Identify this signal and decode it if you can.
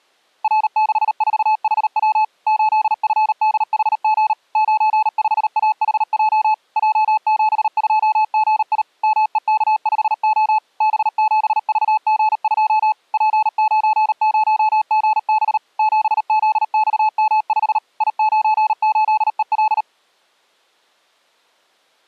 Morse code, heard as a keyed tone, machine-sent, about 38 wpm, 860 Hz. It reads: R64HW 8FDHG 95AHJ J72GI MEK5O B7VG2 P90GB 7ZXM5 I98EL